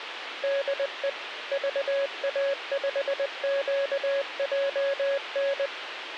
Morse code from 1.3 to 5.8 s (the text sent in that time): VA5QJN